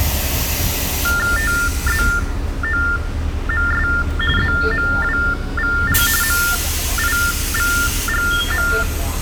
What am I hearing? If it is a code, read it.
TTY/TDD text telephone tones (45.45 baud Baudot), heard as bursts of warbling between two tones, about 400 Hz shift, 1600 Hz centre, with the noise inside a bus. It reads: TZOMS ZMWVL MIVGM